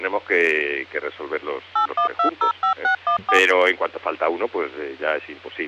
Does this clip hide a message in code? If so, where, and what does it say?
Yes: DTMF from 1.8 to 3.4 s, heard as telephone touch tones, dialled by machine, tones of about 100 ms. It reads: 81205614